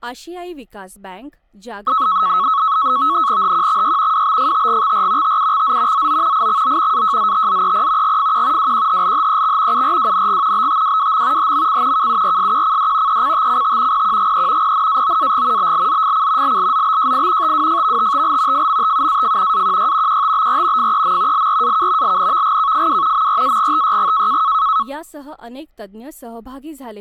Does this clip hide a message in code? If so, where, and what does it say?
Yes: NAVTEX (SITOR-B), 100 baud, 170 Hz shift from 1.9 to 24.8 s, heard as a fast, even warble, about 1200 Hz centre, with speech in Marathi. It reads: HQXY WBFTGXR TUXZ ZO IXO AJZTZEP GFQ WQHLHEX URWNG BTWWM HMC KURSQCD ECTCT PQGE PNAOAG BLZFC LLZBJI TWFVTTL FMTUAF AQY QTBR FEM LRAK LNVGKFW MRAGTYG